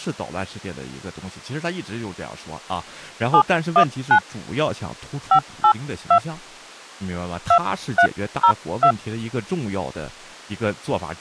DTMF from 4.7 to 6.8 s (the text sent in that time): 582